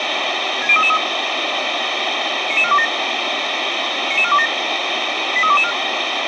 Five-tone selective call (ZVEI), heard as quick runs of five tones, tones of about 70 ms, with radio hiss. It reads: 60333 99427 99427 83224